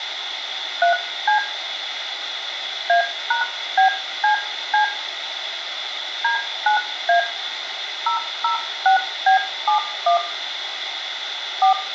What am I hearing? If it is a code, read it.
DTMF, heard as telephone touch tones, dialled by hand, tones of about 110 ms, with phone line noise and room echo. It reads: 3C A#BCC D9A 006B71 4